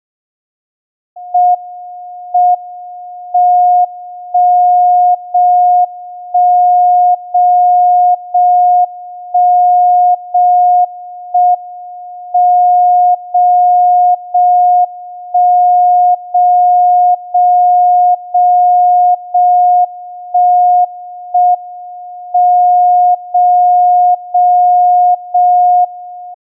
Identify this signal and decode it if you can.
Radio time signal (JJY), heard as a tone whose level steps once a second, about 720 Hz. The time is 23:55 Japan time. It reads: M M 1 0 1 0 0 1 0 1 M 0 0 1 0 0 0 0 1 1 M 0 0 0 1